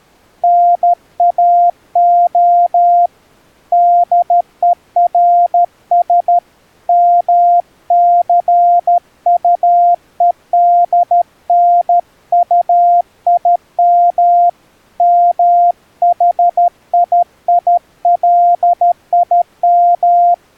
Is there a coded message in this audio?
Yes: Morse code (Hebrew alphabet) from 0.4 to 20.4 s, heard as a keyed tone, hand-sent with a paddle, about 13 wpm, 700 Hz. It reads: נאה דורש מסטודנטים מחיילים